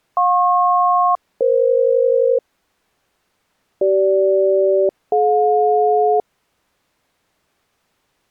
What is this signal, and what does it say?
Aircraft SELCAL, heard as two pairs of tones. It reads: JP-EF CG-DJ